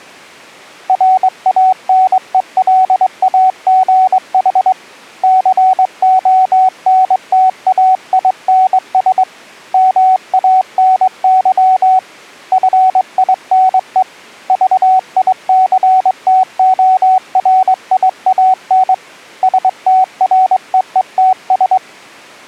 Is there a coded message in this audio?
Yes: Morse code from 0.8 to 21.8 s, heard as a keyed tone, hand-sent with a straight key, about 22 wpm, 750 Hz. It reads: RANELAGH CONTAINS MANY FINE VICTORIAN STREETS